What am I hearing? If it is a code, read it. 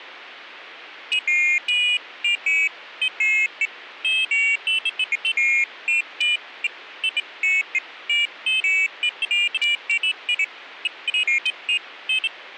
Pairs of high tones at irregular times. There is no code.